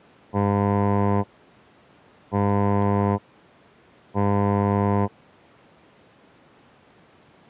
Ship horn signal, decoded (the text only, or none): 3 short